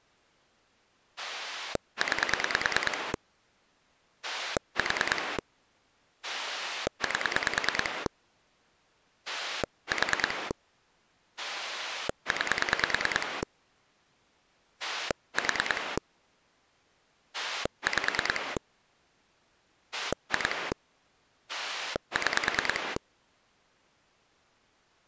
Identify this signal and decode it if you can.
Pulse dialling, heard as a rotary dial, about 9 pulses a second. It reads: 9 4 8 4 9 4 5 2 6